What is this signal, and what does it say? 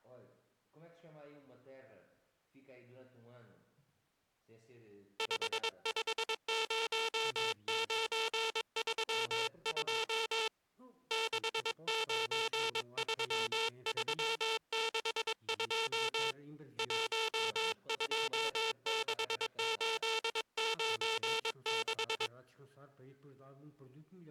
Morse code, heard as a buzzer, hand-sent with a paddle, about 22 wpm. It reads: 550932 693362 126896